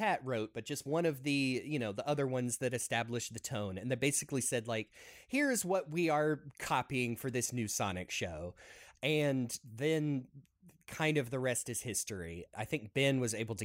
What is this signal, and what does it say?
Speech in English. There is no code.